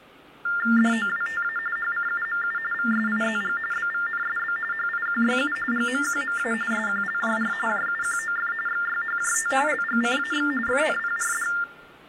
TTY/TDD text telephone tones (45.45 baud Baudot), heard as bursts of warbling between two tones, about 400 Hz shift, 1600 Hz centre, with hum. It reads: DOWTA HCUMU VSIZG BVNSB HIQYU GMQMA SQLJR JUQOF XYHJT LGCAX FNPRD